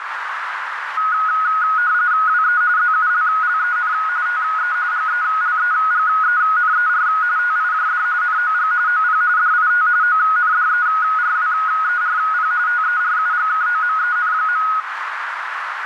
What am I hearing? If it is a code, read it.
RTTY (45.45 baud, 170 Hz shift), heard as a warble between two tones, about 1360 Hz centre, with radio static and a narrow filter. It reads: WE ZULLEN TE GELEGENER TIJD NOG OP DIT ONDERWERP TERUGKOMEN.